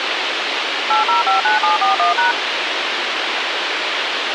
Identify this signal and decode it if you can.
DTMF, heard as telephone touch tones, dialled by machine, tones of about 140 ms, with radio hiss. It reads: 8059741#